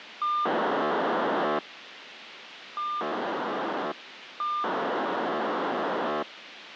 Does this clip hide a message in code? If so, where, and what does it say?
Yes: POCSAG pager data (2400 baud) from 0.2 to 6.2 s, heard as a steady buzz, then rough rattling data, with radio hiss.